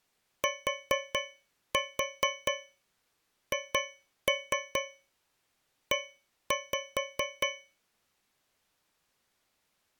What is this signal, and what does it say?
Tap code, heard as taps on a metal pipe, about 4 knocks a second. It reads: THE